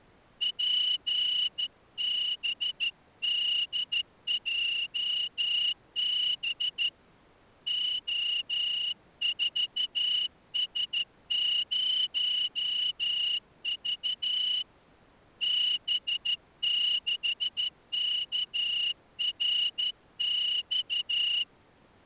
Morse code, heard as a whistle, hand-sent with a straight key, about 13 wpm. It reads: PBDJB O4S0V B6KRX